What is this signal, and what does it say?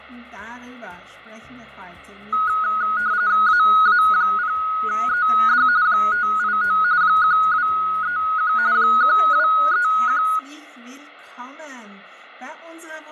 RTTY (45.45 baud, 170 Hz shift), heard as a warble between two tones, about 1360 Hz centre, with radio static and fading. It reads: AA0ED 589 1231 1231